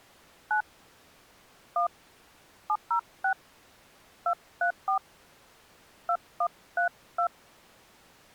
DTMF, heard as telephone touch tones, dialled by hand, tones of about 80 ms. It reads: 9 1 706 234 2132